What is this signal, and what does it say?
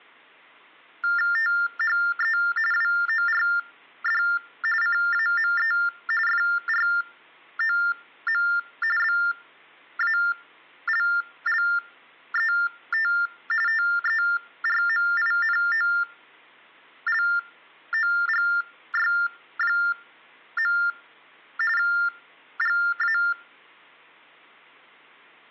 TTY/TDD text telephone tones (45.45 baud Baudot), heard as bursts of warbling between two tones, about 400 Hz shift, 1600 Hz centre. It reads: THE WORD CAME FROM BALLET TERMINOLOGY. GA